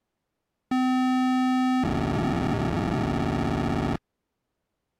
POCSAG pager data (512 baud), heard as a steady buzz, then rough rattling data.